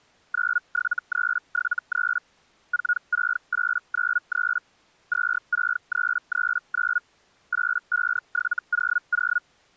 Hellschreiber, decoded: 97373 46893 26339 85700

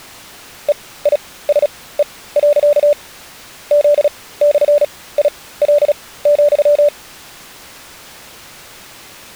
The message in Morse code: EISE. Z/IL,

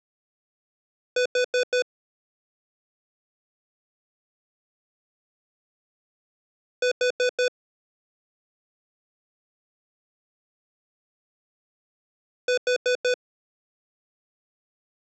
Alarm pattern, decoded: temporal four

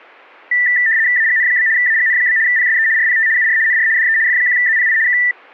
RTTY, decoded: AGN? AGN? PSE RPT UR NR DE F1ZPI K

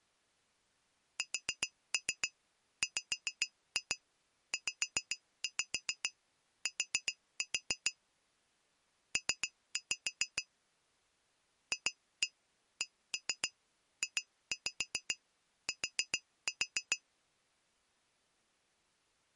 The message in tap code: SWZT P FCJT

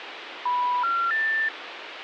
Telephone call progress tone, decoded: special information tone

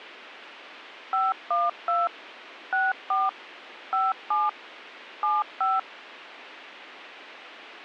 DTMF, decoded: 512 64 57 75

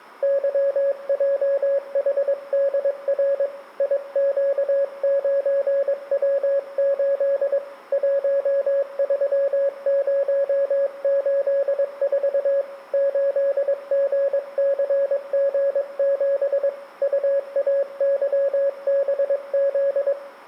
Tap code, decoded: none

